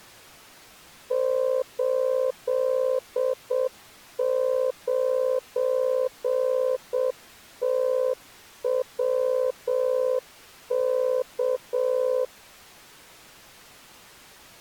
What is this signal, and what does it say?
Morse code, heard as a keyed tone, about 7 wpm, 510 Hz. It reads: 89TWK